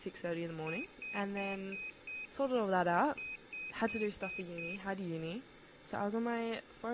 Beep code, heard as a piezo beeper, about 2500 Hz, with speech in English. 5-5.